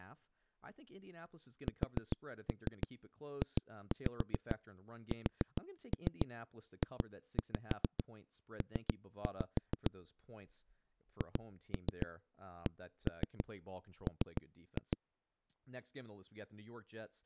Tap code, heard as knocks on a wall, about 6 knocks a second, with speech in English. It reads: SJSJP HCM